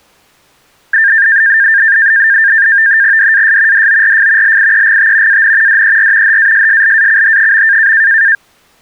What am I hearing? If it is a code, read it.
NAVTEX (SITOR-B), 100 baud, 170 Hz shift, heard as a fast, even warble, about 1700 Hz centre. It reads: DAS DORF LIEGT AN DER HASSLACH.